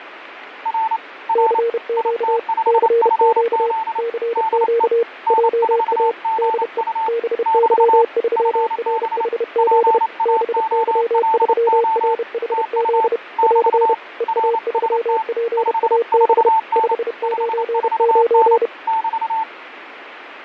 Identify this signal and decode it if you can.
Morse code, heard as two keyed tones, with radio static. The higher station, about 28 wpm, 890 Hz: R R IT5FZ DE N4GU <BT> FB PAOLO TU <BT> RST 54N 54N <BT>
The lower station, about 31 wpm, 460 Hz: CQ CQ CQ JA DE BY3RHZ BY3RHZ <AR> EA3PAB 599